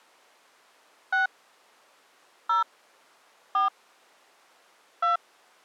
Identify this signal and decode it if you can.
DTMF, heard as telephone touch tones, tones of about 140 ms. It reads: 6 0 4 2